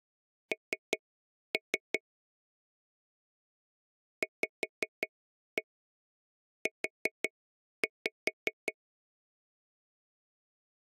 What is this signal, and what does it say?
Tap code, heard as taps on a table, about 5 knocks a second. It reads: N VU